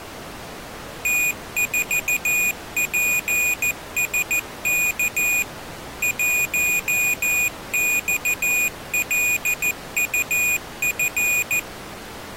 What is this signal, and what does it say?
Morse code, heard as a high beeper, machine-sent, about 14 wpm, 2450 Hz. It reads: T4PSK 1XLUF